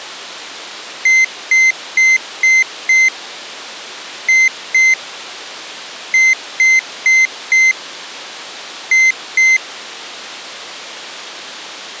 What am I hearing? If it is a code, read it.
Beep code, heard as a piezo beeper, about 2050 Hz. 5-2-4-2.